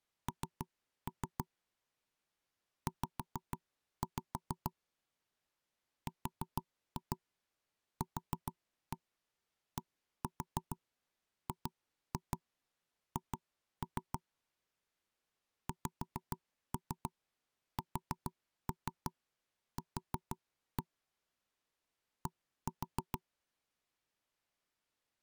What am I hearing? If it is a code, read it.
Tap code, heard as knocks on wood, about 6 knocks a second. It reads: N Z RQDGH XSQ D